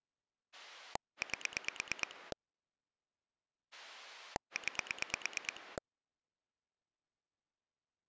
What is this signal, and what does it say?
Pulse dialling, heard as a rotary dial, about 9 pulses a second. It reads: 8 9